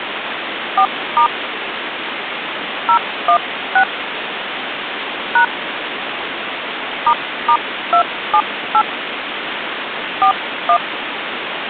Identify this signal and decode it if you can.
DTMF, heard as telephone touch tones, dialled by hand, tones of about 80 ms, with phone line noise. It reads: 4* 016 # **278 41